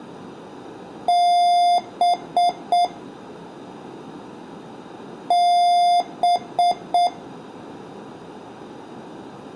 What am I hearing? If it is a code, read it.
Beep code, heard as beeps from a small speaker, played twice, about 700 Hz, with room echo. 1 long, 3 short. In Award and IBM BIOS tables: video adapter failure; in AMI BIOS tables: memory failure.